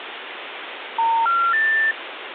Telephone call progress tone (North American plan), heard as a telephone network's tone, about 910, 1370, 1800 Hz, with phone line noise. Special information tone.